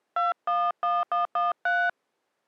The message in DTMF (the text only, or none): 211113